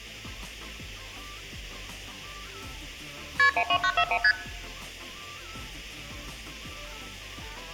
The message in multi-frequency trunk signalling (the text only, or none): KP 12941 ST